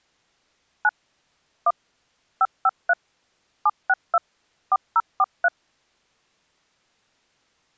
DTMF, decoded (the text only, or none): 9 1 553 762 4043